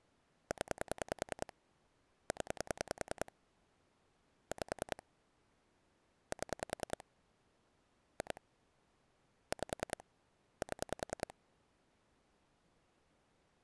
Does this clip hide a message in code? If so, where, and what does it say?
Yes: pulse dialling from 0.5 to 11.3 s, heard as clicks on a phone line, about 10 pulses a second. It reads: 0 0 5 7 2 5 7